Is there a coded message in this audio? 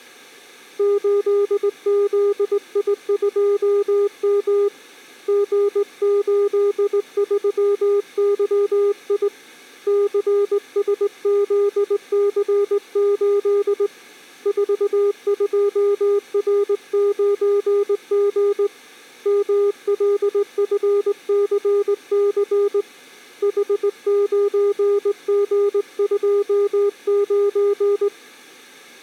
Yes: Morse code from 0.7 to 28.1 s, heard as a keyed tone, hand-sent with a straight key, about 19 wpm, 400 Hz. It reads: 8ZI2M G83YI CSZC8 42R9G MLFCC H9G29